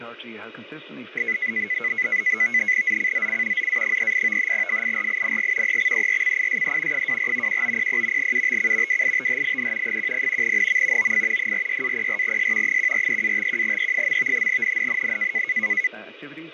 NAVTEX (SITOR-B), 100 baud, 170 Hz shift, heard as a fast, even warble, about 2100 Hz centre. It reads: ZCZC ZA38 FIRING EXERCISE 24 1900 UTC WITHIN 10 NM OF 46-04S 143-51E. NNNN